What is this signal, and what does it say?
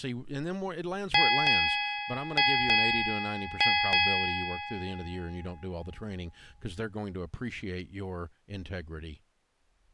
Ship's bell, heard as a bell, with speech in English. 6. Six half-hours of the watch have passed.